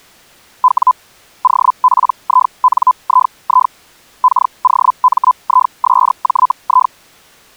Hellschreiber (Feld-Hell, 122.5 baud), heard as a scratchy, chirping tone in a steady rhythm, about 1010 Hz. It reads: W OPINII KOMISJI